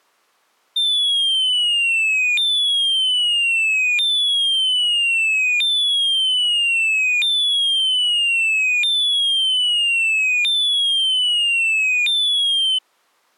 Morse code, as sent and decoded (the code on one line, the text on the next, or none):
none